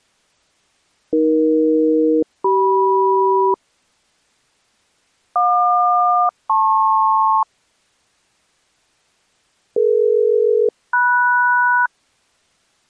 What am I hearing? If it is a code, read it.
Aircraft SELCAL, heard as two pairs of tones. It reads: AE-CM JQ-LP DE-MS